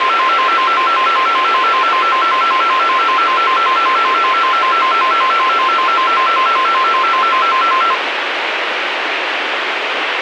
A tone that alternates evenly between two pitches, with radio hiss. There is no code.